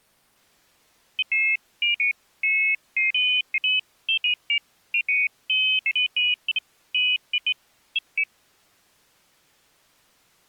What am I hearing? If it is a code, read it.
Pairs of high tones at irregular times. There is no code.